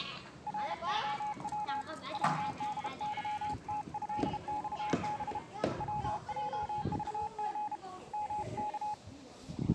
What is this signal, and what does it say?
Morse code (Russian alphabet), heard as a keyed tone, hand-sent with a paddle, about 32 wpm, 840 Hz, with the noise of a park. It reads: РОВ ВДЫТЭЬБ ВЙЖГ МК